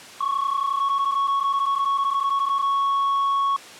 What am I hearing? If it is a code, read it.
PSK31 (31.25 baud), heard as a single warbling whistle, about 1110 Hz.